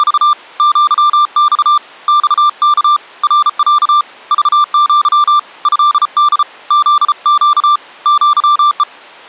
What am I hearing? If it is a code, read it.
Morse code (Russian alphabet), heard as a keyed tone, hand-sent with a paddle, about 34 wpm, 1180 Hz. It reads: … ЪЬ ЬК РЯ ЖЪ ЭД ЗЩ ЪЕ